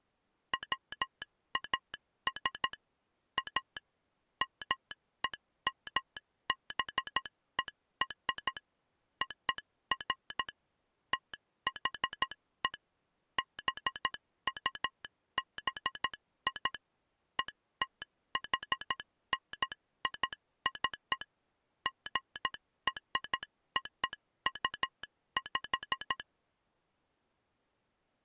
Morse code (American railroad code), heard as a telegraph sounder, machine-sent. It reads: WAS A MEMBER OF THE BUBI ETHNIC GROUP